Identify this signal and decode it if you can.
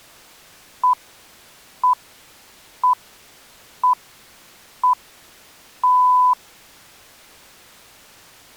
Radio time signal (six pips, as the Greenwich Time Signal), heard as pips.